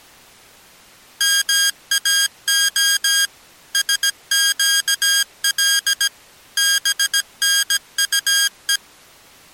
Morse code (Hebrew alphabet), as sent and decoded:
-- .- --- / ... --.- .-.. / -... -. ..- .
מאה שקל בנטו

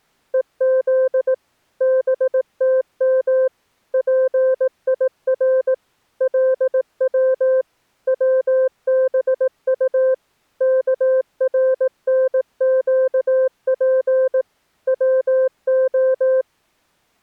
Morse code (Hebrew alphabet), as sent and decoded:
. --.. / -... - -- / .--. .. .-. / .-.. .-- / .-- -... ..- / -.- .-. -. --.- .--. / .-- ---
וז בתם פיר לץ צבט כרנקף צה

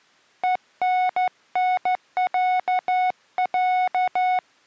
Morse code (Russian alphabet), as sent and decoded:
. -. -. .-.- .-.-
ЕННЯЯ

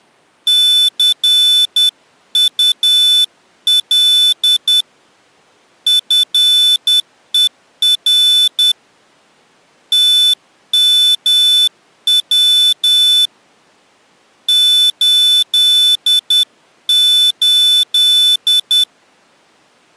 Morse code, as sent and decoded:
-.-. ..- .-.. / ..-. . .-. / - -- .-- / ---.. ---..
CUL FER TMW 88

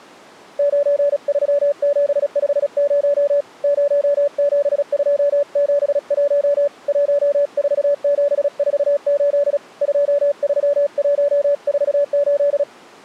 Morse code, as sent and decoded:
----. ...-- --... ..... ----- / ----- --... ..--- --... .---- / .---- ....- --... ....- ---.. / ..--- ...-- .---- ....- ---..
93750 07271 14748 23148

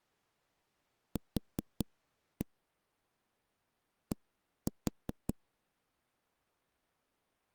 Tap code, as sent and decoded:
4-1 / 1-4
Q D

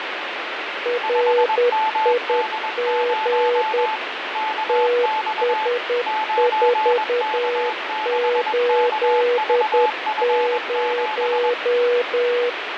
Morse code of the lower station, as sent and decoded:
.-. .. --. / - ... ....- ---.. -----
RIG TS480

